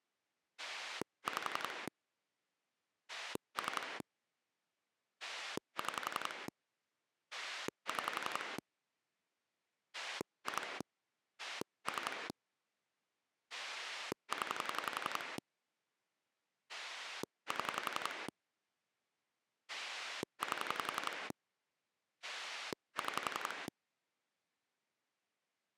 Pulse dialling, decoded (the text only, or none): 5 3 6 6 2 3 0 7 8 6